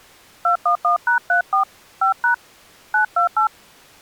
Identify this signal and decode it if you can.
DTMF, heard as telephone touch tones, dialled by hand, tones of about 110 ms. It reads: 211#34 5# 928